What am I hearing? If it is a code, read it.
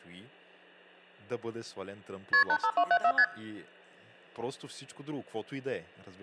Multi-frequency trunk signalling (R1, as on North American trunks), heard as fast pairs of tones, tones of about 70 ms, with hum and speech in Bulgarian. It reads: KP 85274 ST